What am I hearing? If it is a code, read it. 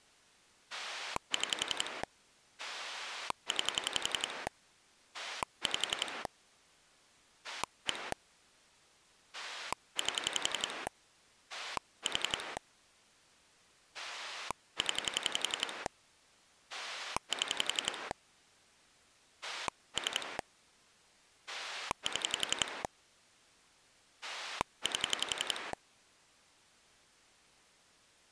Pulse dialling, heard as a rotary dial, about 11 pulses a second. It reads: 6 9 5 1 8 4 0 7 3 7 8